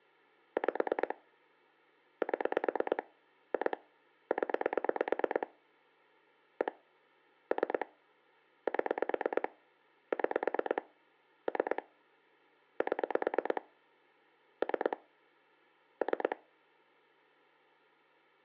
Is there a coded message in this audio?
Yes: pulse dialling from 0.6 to 16.3 s, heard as clicks on a phone line, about 9 pulses a second. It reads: 5 7 2 0 1 3 7 6 3 7 3 3